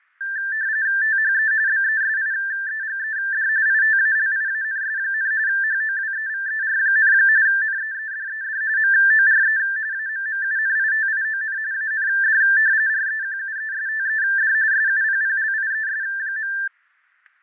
RTTY (45.45 baud, 170 Hz shift), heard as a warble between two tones, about 1650 Hz centre, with fading and static crashes. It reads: THE BESIEGED ITALIANS, HOWEVER, NEEDED MORE AMMUNITION AND REQUESTED SUPPLIES.